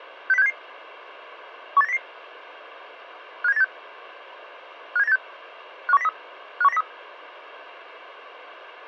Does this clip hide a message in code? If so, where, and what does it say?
Yes: five-tone selective call (EEA) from 0.3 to 6.8 s, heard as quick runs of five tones, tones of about 40 ms. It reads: 60677 18900 57986 57986 51903 51903